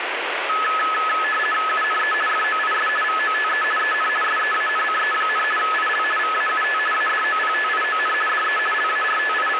RTTY (50 baud, 450 Hz shift), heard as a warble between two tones, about 1500 Hz centre, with radio static. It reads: UNE FOIS VOTE EN SEANCE, IL VAUT ADOPTION DE …